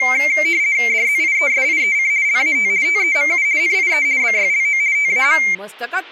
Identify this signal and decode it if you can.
RTTY (50 baud, 170 Hz shift), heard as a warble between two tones, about 2200 Hz centre, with speech in Goan Konkani. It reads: DZIESIEC LAT TEMU NIE BYLO TAM